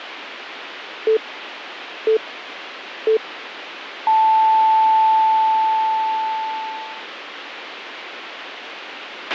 Radio time signal (three low pips and a long one an octave up, as on NHK), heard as pips, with a squelch burst at the end.